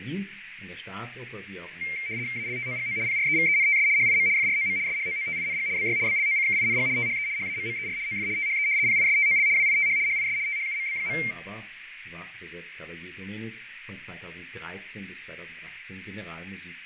RTTY (75 baud, 170 Hz shift), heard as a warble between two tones, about 2200 Hz centre, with radio static, fading and a narrow filter. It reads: ALTOGO PREVENTS HIM FROM SHOOTING BY BLOCKING THE HAMMER OF THE PISTOL WITH HIS THUMB.